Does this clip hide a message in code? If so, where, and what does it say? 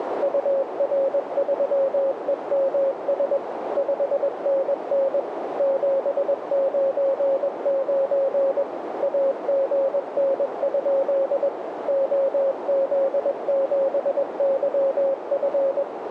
Yes: Morse code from 0.2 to 15.9 s, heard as a keyed tone, machine-sent, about 21 wpm, 540 Hz, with radio static and a narrow filter. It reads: UR3EMS 5NN 799 AGN? OZ7YF